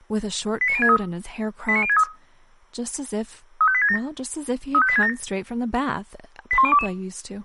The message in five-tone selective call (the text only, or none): 89063 89063 35867 35867 81022